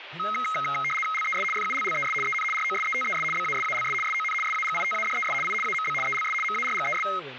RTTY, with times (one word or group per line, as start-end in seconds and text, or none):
1.1-1.4 LES
1.5-2.1 FULLES
2.2-2.4 EN
2.5-3.2 ROSETES
3.3-3.9 BASALS
4.0-4.3 SON
4.4-5.3 SAGITADES
5.4-5.5 I
5.6-5.9 AMB
6.0-6.3 ELS
6.4-7.0 MARGES